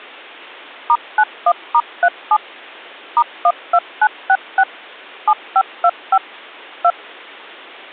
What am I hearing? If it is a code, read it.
DTMF, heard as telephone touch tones, dialled by machine, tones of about 60 ms. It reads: *91*37 *12966 7525 2